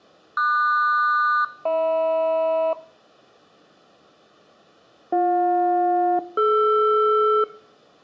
Aircraft SELCAL, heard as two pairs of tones, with room echo. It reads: QS-HM BJ-DR